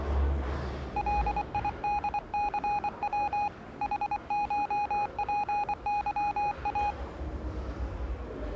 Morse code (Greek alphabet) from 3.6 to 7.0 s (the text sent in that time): ΗΧΠΥΑ